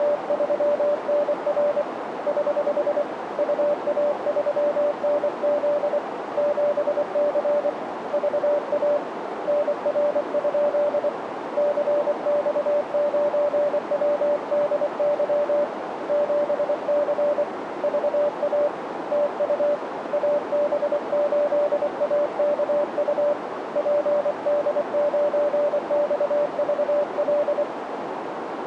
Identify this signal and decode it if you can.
Morse code, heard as a keyed tone, hand-sent with a paddle, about 24 wpm, 590 Hz, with radio static and a narrow filter. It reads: … <HH> UA3NZ 7C VA NR? CX9WDY 7C VA TU AB8AKU PD9XVL